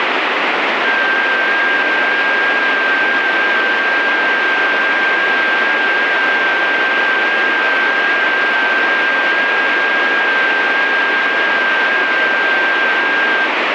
FT8 (one signal), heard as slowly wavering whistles, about 6.25 baud, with heavy radio static.